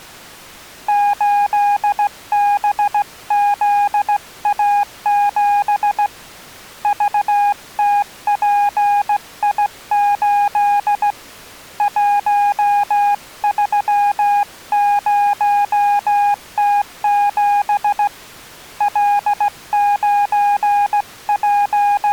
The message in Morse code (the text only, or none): 8BZA7 VTPI8 130T7 …